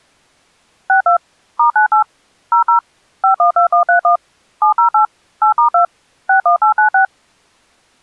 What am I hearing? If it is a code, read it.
DTMF, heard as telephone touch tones, dialled by machine, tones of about 110 ms. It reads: 62 *98 00 512131 708 8*2 61896